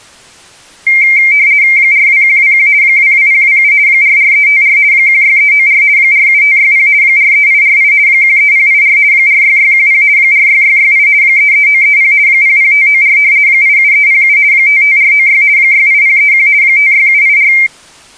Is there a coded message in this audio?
Yes: RTTY (50 baud, 170 Hz shift) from 0.9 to 17.7 s, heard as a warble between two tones, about 2200 Hz centre. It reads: 42121 22027 44354 16394 47560 43848 13084 46610 46668 33930 00594 87307 55496 68031 56784